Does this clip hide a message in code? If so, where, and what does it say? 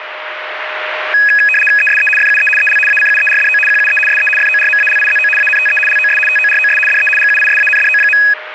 Yes: RTTY (75 baud, 850 Hz shift) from 1.1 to 8.3 s, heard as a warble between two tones, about 2100 Hz centre, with radio static and a steady whistle near 620 Hz. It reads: ESE FUE EL ACUERDO QUE SE FORMALIZO ANTE LOS TOROS DE GUISANDO.